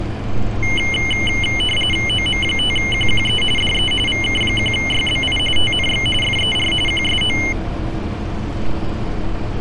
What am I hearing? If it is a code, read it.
RTTY (45.45 baud, 850 Hz shift), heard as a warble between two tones, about 2550 Hz centre, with street noise. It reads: OM5QQE DE VK1YBI TNX FER QSO